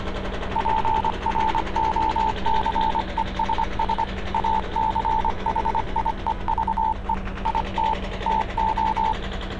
Morse code, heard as a keyed tone, hand-sent with a paddle, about 25 wpm, 880 Hz, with street noise. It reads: PROCESS ACHIEVE IT TO